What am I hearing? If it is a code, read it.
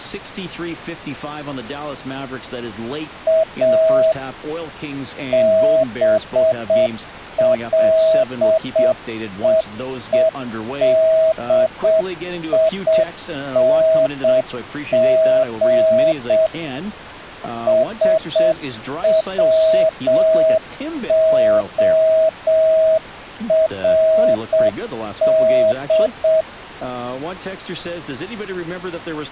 Morse code, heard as a keyed tone, machine-sent, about 7 wpm, 640 Hz, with speech in English. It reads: A BLEEDING SWORD